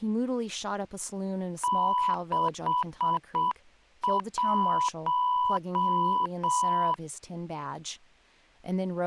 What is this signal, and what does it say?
Morse code, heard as a keyed tone, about 7 wpm, 990 Hz, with speech in English. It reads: 61